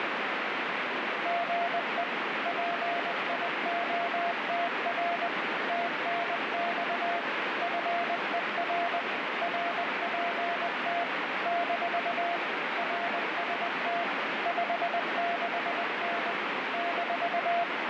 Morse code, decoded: GE PIOTR TNX FER RPT - RST 56N -

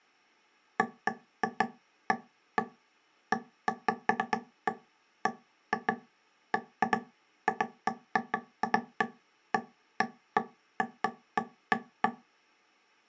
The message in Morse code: none

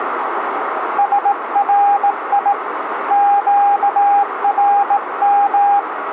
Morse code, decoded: SRI QRM

